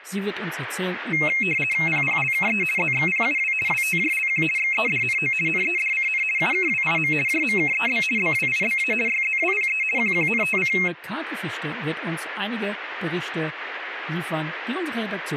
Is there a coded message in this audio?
Yes: RTTY (50 baud, 450 Hz shift) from 1.1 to 10.9 s, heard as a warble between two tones, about 2350 Hz centre. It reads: PPLKE ZXPUW WTJLQ XEDNO NEDCN UKWIM JMKEB BWIBA YZWPE QQNTC